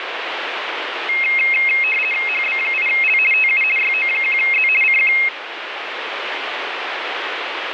RTTY (50 baud, 450 Hz shift), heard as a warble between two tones, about 2350 Hz centre, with radio static. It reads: HB8L TU YO1Z CQ